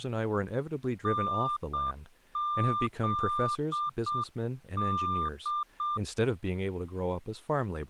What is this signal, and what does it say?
Morse code (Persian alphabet), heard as a keyed tone, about 7 wpm, 1190 Hz, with speech in English. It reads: نزد